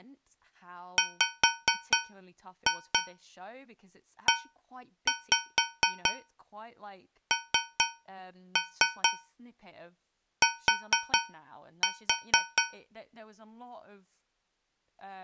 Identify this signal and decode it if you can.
Tap code, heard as taps on a metal pipe, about 4 knocks a second, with speech in English. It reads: WENT